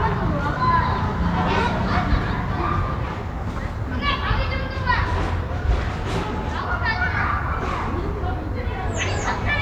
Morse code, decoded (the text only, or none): none